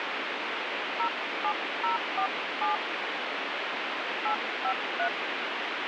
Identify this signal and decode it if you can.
DTMF, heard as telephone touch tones, dialled by hand, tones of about 100 ms, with radio hiss. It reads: 07047 853